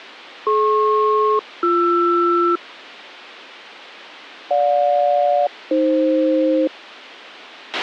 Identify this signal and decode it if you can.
Aircraft SELCAL, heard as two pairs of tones, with a squelch burst at the end. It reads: DP-BR GJ-AF